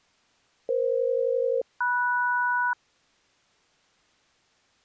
Aircraft SELCAL, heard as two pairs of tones. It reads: EF-MS